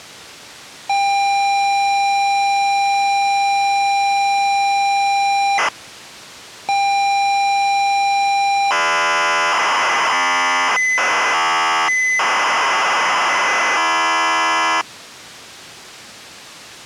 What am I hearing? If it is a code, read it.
ZX Spectrum tape loading, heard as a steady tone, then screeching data.